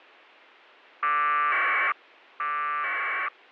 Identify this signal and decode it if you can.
Packet radio (AX.25, as in APRS), 1200 baud, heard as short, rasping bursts.